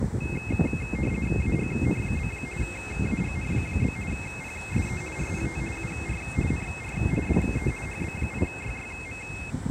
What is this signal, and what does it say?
RTTY (50 baud, 450 Hz shift), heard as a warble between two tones, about 2350 Hz centre, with street noise. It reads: AGN? AGN? PSE RPT UR NR DE HB8YYM